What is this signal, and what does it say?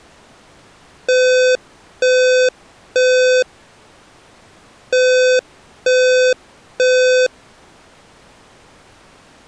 Alarm pattern, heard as an alarm's beeps, played twice, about 510 Hz. Temporal three. Smoke or fire, evacuate.